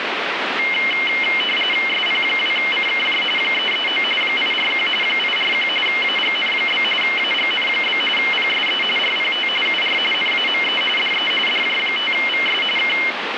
RTTY (45.45 baud, 850 Hz shift), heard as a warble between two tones, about 2550 Hz centre, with radio static. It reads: SP2CKJ 339 841 841 AGN? AGN? PSE RPT UR NAME DE DJ5VS K